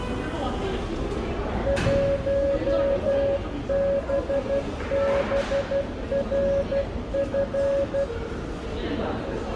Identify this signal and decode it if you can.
Morse code, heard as a keyed tone, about 12 wpm, 560 Hz, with room echo and the noise of a subway station. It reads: 1BBRF